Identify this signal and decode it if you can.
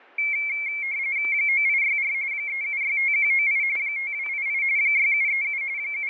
RTTY (45.45 baud, 170 Hz shift), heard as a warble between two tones, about 2250 Hz centre, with fading and static crashes. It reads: 9864 3765198 5288 6737 …